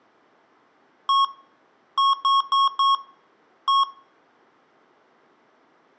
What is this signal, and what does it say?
Beep code, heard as beeps from a small speaker, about 1100 Hz, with room echo. 1-4-1. In Phoenix BIOS tables: address line failure in the first 64 KB of memory.